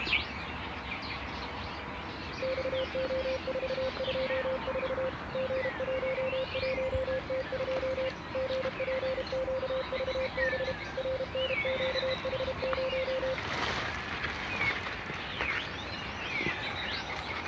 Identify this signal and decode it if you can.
Morse code, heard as a keyed tone, machine-sent, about 32 wpm, 520 Hz. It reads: XO424 G11T2 GPQVB RNQH0